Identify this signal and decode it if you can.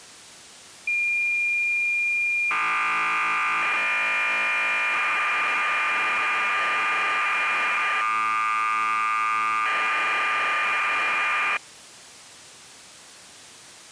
Cassette data (Kansas City type), 1200 baud, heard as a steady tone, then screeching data.